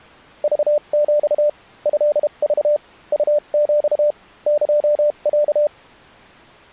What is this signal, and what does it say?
Morse code (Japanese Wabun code), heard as a keyed tone, machine-sent, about 32 wpm, spaced as for 28 wpm, 590 Hz. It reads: クヒ トク ウヒ エロ